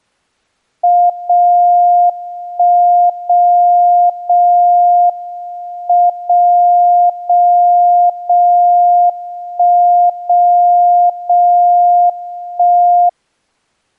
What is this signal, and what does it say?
Radio time signal (WWVB), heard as a tone whose level steps once a second, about 700 Hz. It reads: 0 1 0 0 M 0 0 0 1 0 0 1